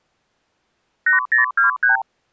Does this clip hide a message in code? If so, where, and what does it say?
Yes: multi-frequency trunk signalling (R2, with the far end's replies) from 1.1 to 2.0 s, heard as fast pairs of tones, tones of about 130 ms. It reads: 8023